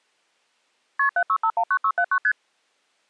Multi-frequency trunk signalling (R1, as on North American trunks), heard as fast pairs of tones, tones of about 70 ms. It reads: KP 76519679 ST